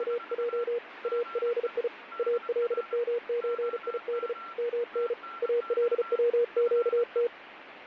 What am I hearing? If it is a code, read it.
Morse code (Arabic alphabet), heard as a keyed tone, hand-sent with a paddle, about 35 wpm, 480 Hz, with radio static and a weaker station near 1360 Hz. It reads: … الي المزيد من الوقت